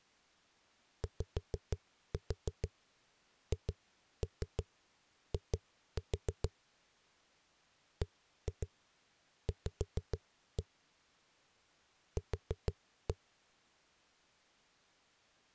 Tap code, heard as knocks on a wall, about 6 knocks a second. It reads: YHI BV Q